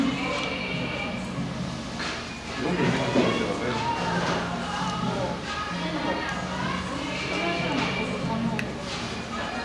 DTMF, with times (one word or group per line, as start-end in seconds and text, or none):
none